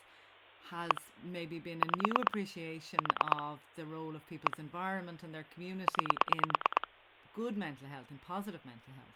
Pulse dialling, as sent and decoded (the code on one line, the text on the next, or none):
1 / 5 / 4 / 1 / 9
1 5 4 1 9